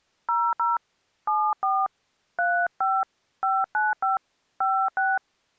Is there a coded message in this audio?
Yes: DTMF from 0.3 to 5.2 s, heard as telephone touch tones, dialled by hand, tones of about 210 ms. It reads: 00 74 35 595 56